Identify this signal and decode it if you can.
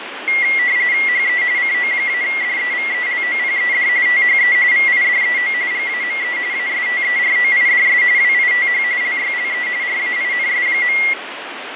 RTTY (45.45 baud, 170 Hz shift), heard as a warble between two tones, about 2050 Hz centre, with radio static. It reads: HE CO-DEVELOPED THE VIDEO GAME ASTEROIDS WITH LYLE RAINS.